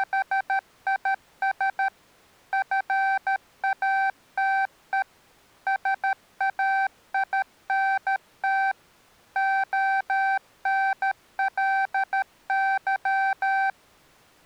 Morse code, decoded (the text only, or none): … FATE SAINT ONLY